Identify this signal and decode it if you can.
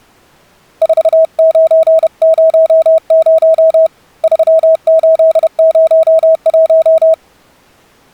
Morse code, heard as a keyed tone, hand-sent with a paddle, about 31 wpm, 640 Hz. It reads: 4900 3801